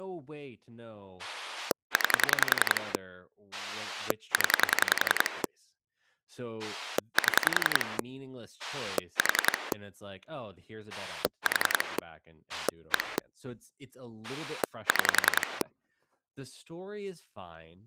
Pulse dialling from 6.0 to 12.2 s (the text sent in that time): 7 4 4